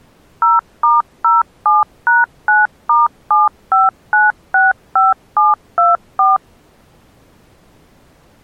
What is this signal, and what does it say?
DTMF, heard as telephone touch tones, dialled by machine, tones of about 170 ms. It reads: 0*07#9*75965724